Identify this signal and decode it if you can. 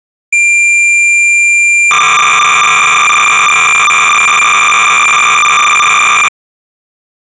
Cassette data (Kansas City type), 300 baud, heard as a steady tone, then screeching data.